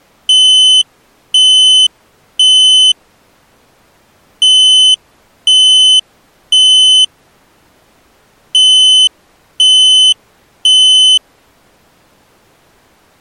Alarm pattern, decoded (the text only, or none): temporal three